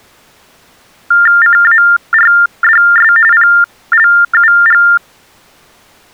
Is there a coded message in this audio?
Yes: TTY/TDD text telephone tones (45.45 baud Baudot) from 1.1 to 5.0 s, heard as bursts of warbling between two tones, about 400 Hz shift, 1600 Hz centre. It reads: CARDS PLUG